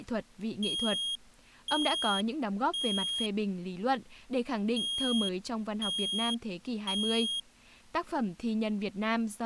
Alarm pattern, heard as an alarm's beeps, played twice, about 3250 Hz, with speech in Vietnamese. Temporal three. Smoke or fire, evacuate.